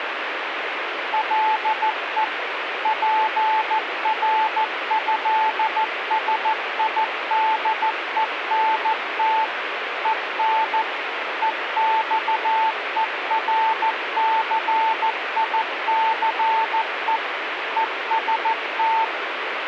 Morse code (with French letters), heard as a keyed tone, machine-sent, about 14 wpm, 880 Hz, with radio static. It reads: LE PRÉSIDENT EN EXERCICE EST